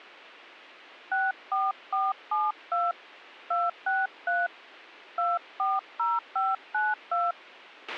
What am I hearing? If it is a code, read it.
DTMF, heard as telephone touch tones, dialled by hand, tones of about 200 ms, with a squelch burst at the end. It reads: 64472 263 240592